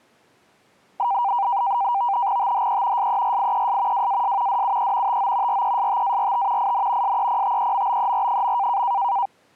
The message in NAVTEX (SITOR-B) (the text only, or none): THE SERIES WAS DUE TO RESTART IN SEPTEMBER.